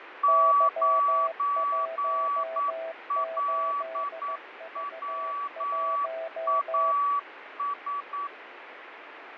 Morse code, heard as two keyed tones, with radio static and fading. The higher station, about 9 wpm, 1140 Hz: 9LWAS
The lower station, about 15 wpm, 660 Hz: Y18V1